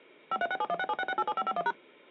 DTMF, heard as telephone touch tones, dialled by machine, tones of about 50 ms. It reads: 53671676687551#